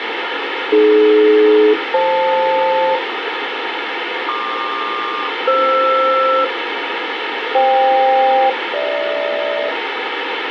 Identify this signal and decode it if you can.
Aircraft SELCAL, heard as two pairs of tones, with radio hiss. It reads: AD-FL PQ-FR FK-GH